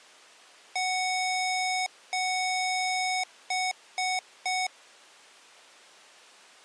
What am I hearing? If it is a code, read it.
Beep code, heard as beeps from a small speaker, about 740 Hz. 2 long, 3 short.